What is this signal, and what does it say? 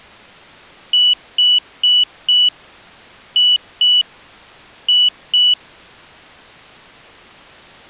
Beep code, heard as a piezo beeper, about 2950 Hz. 4-2-2. In Phoenix BIOS tables: shutdown test failure.